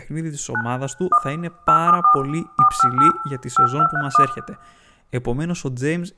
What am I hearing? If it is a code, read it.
DTMF, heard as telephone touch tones, dialled by hand, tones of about 90 ms, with room echo and speech in Greek. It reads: 9 1 874 458 5231